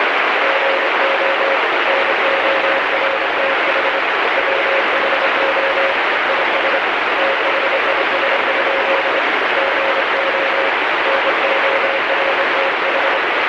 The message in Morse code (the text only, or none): GO NORTH WHO IS THIS? GO NORTH